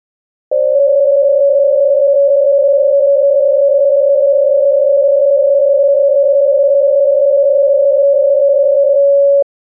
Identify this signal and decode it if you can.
PSK63 (62.5 baud), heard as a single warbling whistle, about 560 Hz.